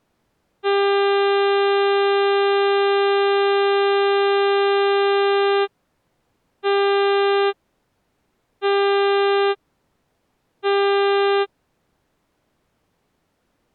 Ship horn signal, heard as a ship's horn, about 400 Hz. 1 long, 3 short. At sea: a vessel under tow in fog.